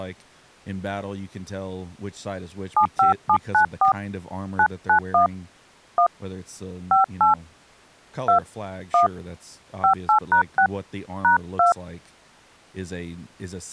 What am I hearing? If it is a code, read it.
DTMF, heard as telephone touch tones, dialled by hand, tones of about 100 ms, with speech in English. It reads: 75794 991 1 58 2 1 58#6 #2